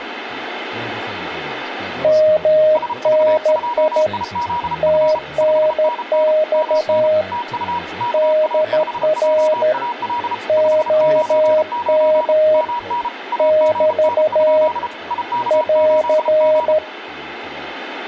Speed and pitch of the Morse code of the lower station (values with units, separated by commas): 13 wpm, 620 Hz